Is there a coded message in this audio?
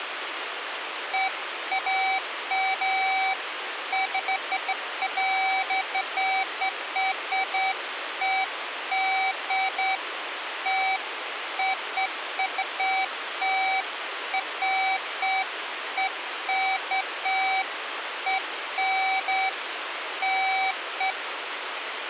No, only beeps of irregular length, with phone line noise.